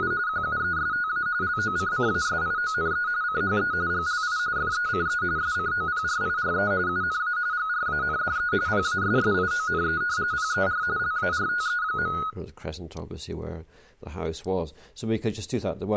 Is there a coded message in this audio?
Yes: RTTY (45.45 baud, 170 Hz shift) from 0.0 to 12.3 s, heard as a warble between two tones, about 1360 Hz centre, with room echo. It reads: … QUESTA LOCCASIONE CHE GLI FECE SCOPRIRE UNA GRANDE PASSIONE PER LARTE.